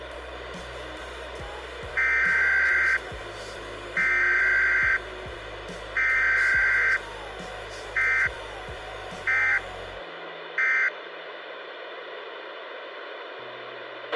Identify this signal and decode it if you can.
Emergency Alert System (SAME) tones (header bursts, then end-of-message bursts), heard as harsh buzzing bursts, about 520.83 baud, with radio hiss and a squelch burst at the end.